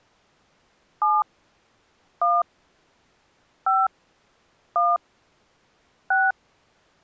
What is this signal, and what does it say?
DTMF, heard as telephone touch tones, dialled by hand, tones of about 200 ms. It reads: 7 1 5 1 6